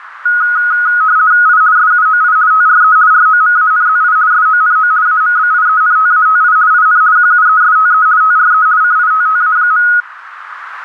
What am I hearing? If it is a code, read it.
RTTY (50 baud, 170 Hz shift), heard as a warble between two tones, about 1360 Hz centre, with radio static and a narrow filter. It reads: I SUOI TRE ROMANZI SONO AMBIENTATI IN QUESTE TRE CITTA.